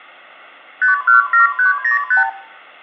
Multi-frequency trunk signalling (R2, with the far end's replies), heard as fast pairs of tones, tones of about 130 ms, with room echo. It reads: 517305